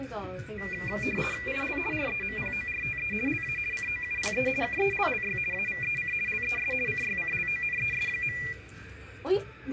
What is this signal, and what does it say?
RTTY (50 baud, 450 Hz shift), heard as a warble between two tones, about 2200 Hz centre, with radio static, a steady whistle near 740 Hz, room echo and the noise of a cafe. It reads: IL REMPORTE LA COUPE KELLY AVEC LES CYCLONES.